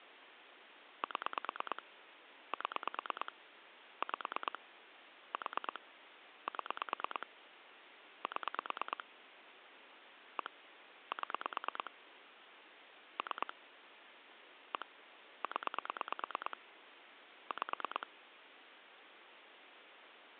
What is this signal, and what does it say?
Pulse dialling, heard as clicks on a phone line, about 9 pulses a second, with phone line noise. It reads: 7 7 5 4 7 7 1 7 3 1 0 5